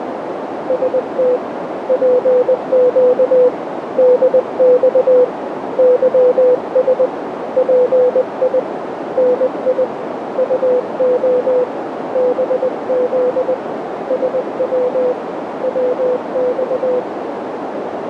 Morse code, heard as a keyed tone, hand-sent with a paddle, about 20 wpm, 500 Hz, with heavy radio static and a narrow filter. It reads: ST PQ DX YS PI NI UO BZ SW WX